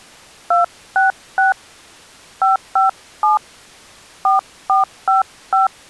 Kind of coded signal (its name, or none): DTMF